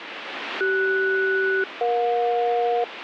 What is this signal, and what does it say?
Aircraft SELCAL, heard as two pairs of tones, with radio static. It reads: CS-EJ